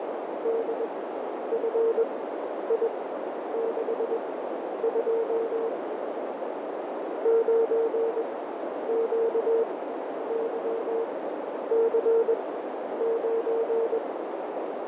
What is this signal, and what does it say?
Morse code, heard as a keyed tone, machine-sent, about 21 wpm, spaced as for 10 wpm, 460 Hz, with heavy radio static, fading and a narrow filter. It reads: DFI62 9QYC9